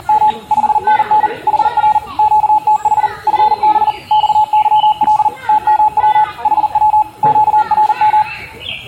Morse code, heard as a keyed tone, machine-sent, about 40 wpm, 850 Hz, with room echo and the noise of a park. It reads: … 5NN HR QTH FB XYL TMW HW QRM